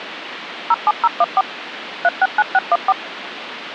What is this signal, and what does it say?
DTMF, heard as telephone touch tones, dialled by machine, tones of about 40 ms, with phone line noise. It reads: 07014 369614